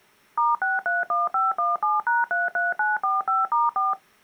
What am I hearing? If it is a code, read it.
DTMF, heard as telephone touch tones, dialled by machine, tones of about 170 ms. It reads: *631517#33945*4